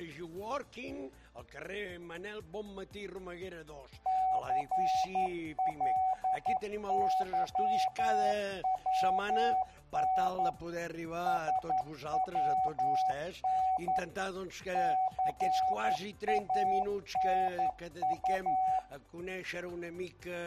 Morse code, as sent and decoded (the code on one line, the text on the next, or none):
-.-. .-.. -.-- .-- -. / ... .-- -. / -.-. .- -. ..-
CLYWN SWN CANU